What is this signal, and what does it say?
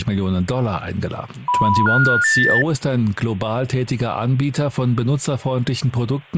Telephone call progress tone (North American plan), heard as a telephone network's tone, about 980, 1430, 1800 Hz, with speech in German. Special information tone.